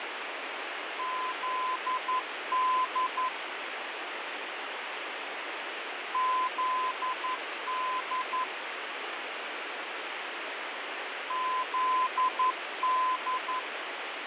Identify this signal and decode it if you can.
Morse code, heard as a keyed tone, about 11 wpm, 1020 Hz, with heavy radio static and fading. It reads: ZD ZD ZD